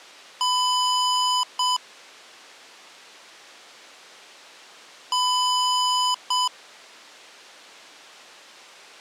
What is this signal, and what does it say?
Beep code, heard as beeps from a small speaker, played twice, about 1000 Hz. 1 long, 1 short. In IBM BIOS tables: system board problem.